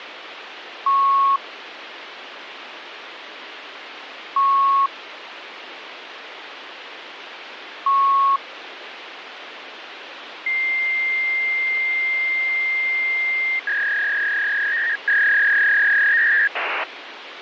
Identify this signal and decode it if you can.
Fax machine handshake, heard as beeps, a long tone and a warble, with phone line noise.